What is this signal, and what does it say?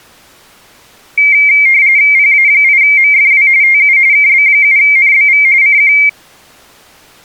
RTTY (45.45 baud, 170 Hz shift), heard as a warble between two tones, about 2200 Hz centre. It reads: PA8MFW TU KB7NBV CQ